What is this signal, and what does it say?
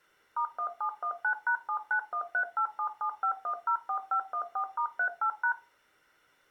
DTMF, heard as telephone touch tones, dialled by machine, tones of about 90 ms. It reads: *1719#79138775104514*38#